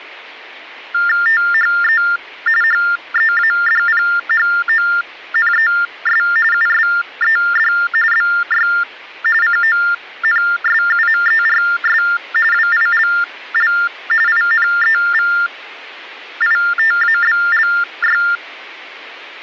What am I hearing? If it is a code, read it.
TTY/TDD text telephone tones (45.45 baud Baudot), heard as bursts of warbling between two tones, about 400 Hz shift, 1600 Hz centre. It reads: THE HEADPHONES USED BY CONSUMERS WILL INEVITABLY